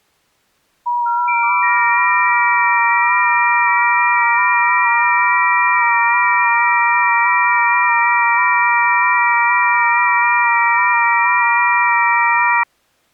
FT8 (several signals at once), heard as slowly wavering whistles, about 6.25 baud.